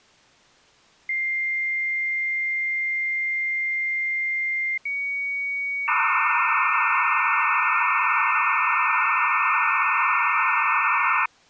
Dial-up modem handshake (low-speed, two carriers), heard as two whistles, then hiss.